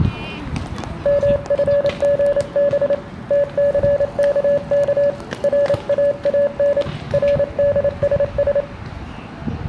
Morse code, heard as a keyed tone, hand-sent with a paddle, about 28 wpm, 570 Hz, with room echo and the noise of a residential street. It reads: MFGB TCKK RAAN RDSS